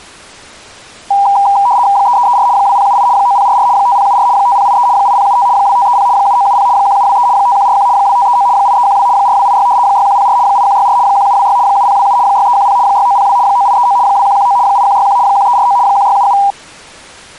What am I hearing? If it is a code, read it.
RTTY (75 baud, 170 Hz shift), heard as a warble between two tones, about 880 Hz centre. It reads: 3334 2078 9044 5074 5083 8075 2530 7970 1723 5141 2539 8312 4286 6104 8164 1726 7027 6310 6902 9839 2119 8161 1349 1677